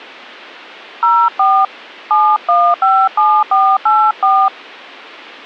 DTMF, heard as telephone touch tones, dialled by hand, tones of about 260 ms. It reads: 04 7157484